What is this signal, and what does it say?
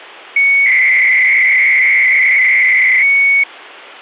300-baud modem data (Bell 103 tones), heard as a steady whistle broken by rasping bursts, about 300 baud, 200 Hz shift.